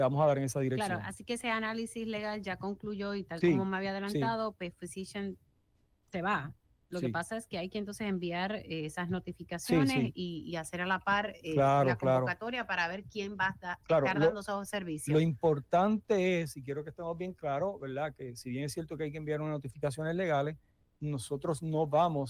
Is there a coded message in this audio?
No.